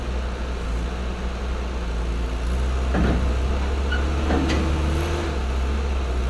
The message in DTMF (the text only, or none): none